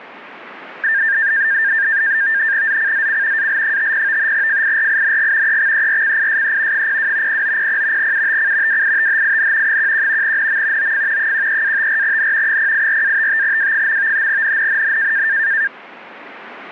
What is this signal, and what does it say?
NAVTEX (SITOR-B), 100 baud, 170 Hz shift, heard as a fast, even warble, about 1700 Hz centre. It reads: ZCZC AL50 FIRING EXERCISE 02 0900 UTC WITHIN 11 NM OF 13-54N 084-55W. NNNN